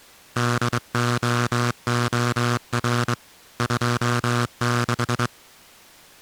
Morse code, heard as a buzzer, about 23 wpm. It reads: DOOR 26